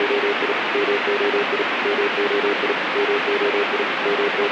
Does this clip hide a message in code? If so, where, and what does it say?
Yes: Morse code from 0.0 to 4.5 s, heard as a keyed tone, machine-sent, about 37 wpm, 410 Hz, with radio static. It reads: … MOI MOI MOI …